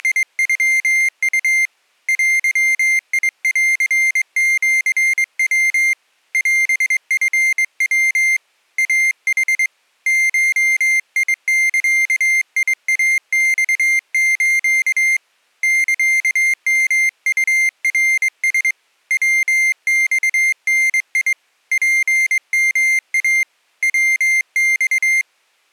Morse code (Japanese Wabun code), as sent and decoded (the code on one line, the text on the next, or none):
… / .-.-- .. .-.-. --.-. .-- / .-... ..-. .-- / .- .... / ---- .. -.-.- .. .- -..- ---.- / -.-.- -- ..- .-. ... / .-- -..- -. .. / .--. -- .- / .-- -..-
… デンシヤ オチヤ イヌ ゴザイマス サヨウナラ ヤマダ ツヨイ ヤマ